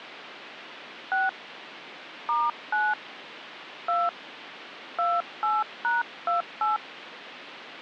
DTMF, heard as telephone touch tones, dialled by hand, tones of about 170 ms, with phone line noise. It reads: 6 *9 2 28#28